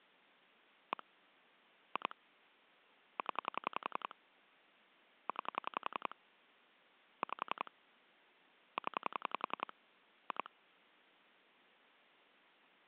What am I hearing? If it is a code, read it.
Pulse dialling, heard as clicks on a phone line, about 11 pulses a second. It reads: 1 2 0 9 5 0 2